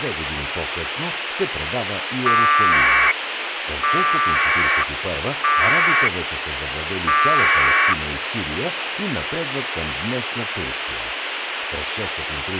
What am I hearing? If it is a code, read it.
Packet radio (AX.25, as in APRS), 1200 baud, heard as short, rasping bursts, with radio hiss and speech in Bulgarian.